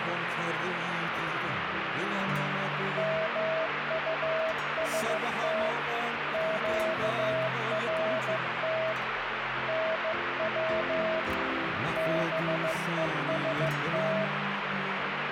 Morse code, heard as a keyed tone, hand-sent with a bug key, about 15 wpm, 640 Hz, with radio static. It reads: MUST QRT NW BEST